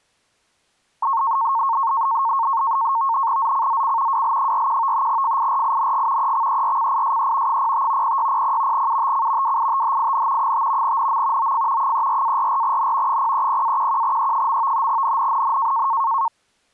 NAVTEX (SITOR-B), 100 baud, 170 Hz shift, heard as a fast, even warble, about 1000 Hz centre. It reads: ZCZC WL41 FIRING EXERCISE 05 0600 UTC WITHIN 5 NM OF 34-44N 030-11E. NNNN